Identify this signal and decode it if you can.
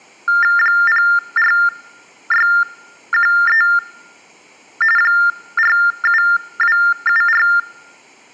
TTY/TDD text telephone tones (45.45 baud Baudot), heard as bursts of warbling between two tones, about 400 Hz shift, 1600 Hz centre. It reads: 04613 47274